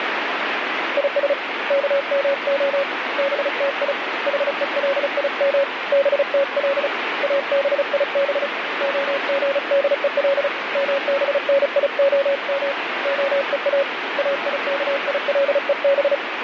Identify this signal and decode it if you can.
Morse code (Hebrew alphabet), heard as a keyed tone, hand-sent with a paddle, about 35 wpm, 560 Hz, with radio static. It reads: יש כמה בתי חולים בתל אביב הגדול מבניהם הוא איכילוב